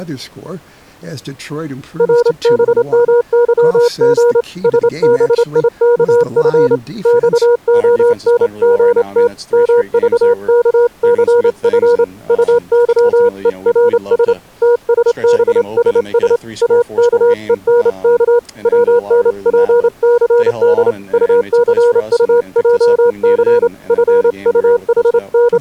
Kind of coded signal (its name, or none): Morse code